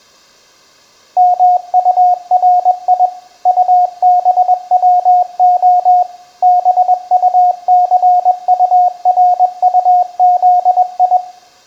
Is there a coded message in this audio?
Yes: Morse code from 1.1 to 11.2 s, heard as a keyed tone, machine-sent, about 21 wpm, 720 Hz, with room echo. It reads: MURI UBWO BUCURUZI